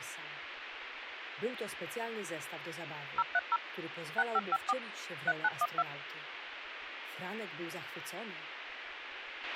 DTMF, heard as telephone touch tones, dialled by machine, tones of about 40 ms, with radio hiss and a squelch burst at the end. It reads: 030 6554 3912